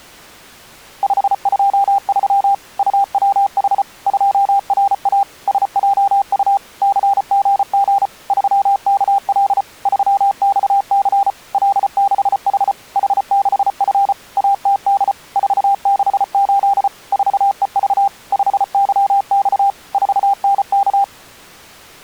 Morse code, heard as a keyed tone, machine-sent, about 34 wpm, 800 Hz. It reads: 523 UWH 2RA SJU CGG 3KL 3XC L6H H6F ATD 468 4EV 5YX 4NK